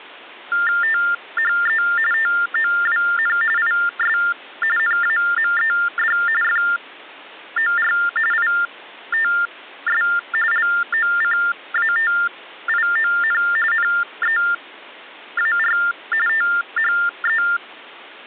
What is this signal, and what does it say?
TTY/TDD text telephone tones (45.45 baud Baudot), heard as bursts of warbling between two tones, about 400 Hz shift, 1600 Hz centre. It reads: THE TOWN IS NAMED FOR ITS LOCATION NEAR THE